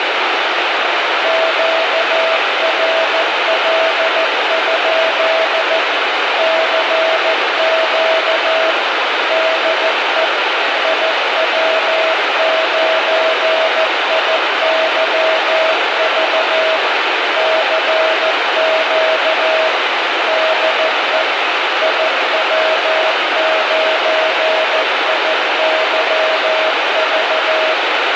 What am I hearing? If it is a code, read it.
Morse code, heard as a keyed tone, machine-sent, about 14 wpm, 640 Hz, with heavy radio static. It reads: QRL? CQ DE IW9IYV CQ DE IW9IYV